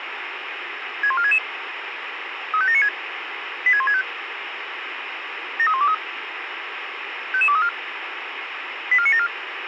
Five-tone selective call (ZVEI), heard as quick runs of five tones, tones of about 70 ms, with radio hiss. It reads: 61466 35796 86165 73123 55234 84974